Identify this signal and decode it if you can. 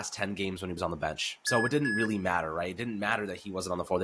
Beep code, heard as beeps from a small speaker, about 1700 Hz, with speech in English. 2 short. In AMI BIOS tables: memory parity error; in IBM BIOS tables: self-test error shown on screen; in Dell tables: no memory detected.